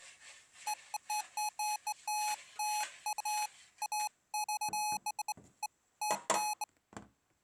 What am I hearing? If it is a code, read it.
Beeps of irregular length, with kitchen noise. There is no code.